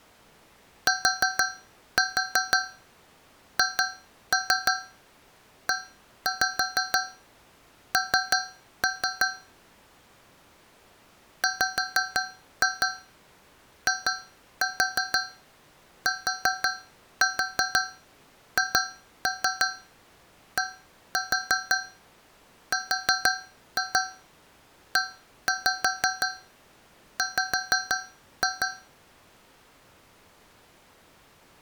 Tap code, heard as taps on a metal pipe, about 6 knocks a second. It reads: THEN WITHDREW